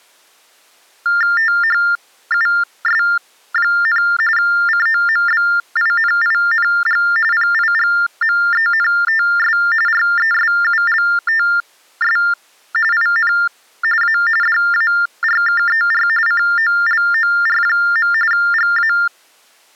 TTY/TDD text telephone tones (45.45 baud Baudot), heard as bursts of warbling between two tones, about 400 Hz shift, 1600 Hz centre. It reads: THUS, COMBINING PIGMENTS RESULTS IN A DARKER COLOR. GA